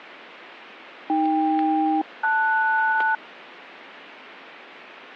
Aircraft SELCAL, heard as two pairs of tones. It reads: AK-LS